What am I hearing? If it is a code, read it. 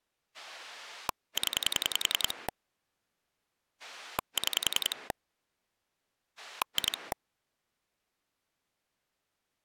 Pulse dialling, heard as a rotary dial, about 10 pulses a second. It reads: 0 6 2